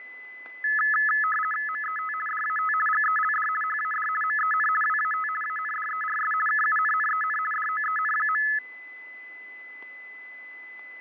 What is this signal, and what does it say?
RTTY (50 baud, 450 Hz shift), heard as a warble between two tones, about 1500 Hz centre, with fading and a steady whistle near 2010 Hz. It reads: MET DAT GELD HAD MEN WAT ANDERS KUNNEN DOEN.